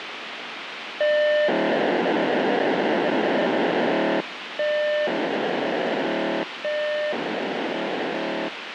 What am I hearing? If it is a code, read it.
POCSAG pager data (1200 baud), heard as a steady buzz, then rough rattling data, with radio hiss.